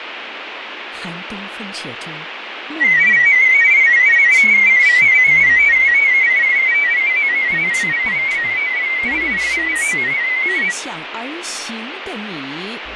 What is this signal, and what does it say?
Multi-tone FSK (Olivia or MFSK type), about 500 Hz wide, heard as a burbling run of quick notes, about 31.25 baud, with radio static and fading.